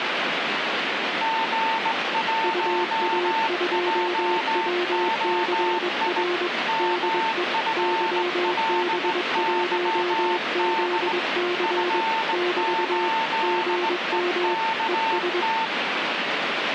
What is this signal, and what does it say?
Morse code, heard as two keyed tones, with radio static. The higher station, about 18 wpm, 900 Hz: G1JOI MFLYD F8EKT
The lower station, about 22 wpm, 350 Hz: UA2WCR DE YB1ZC <BT> GM ES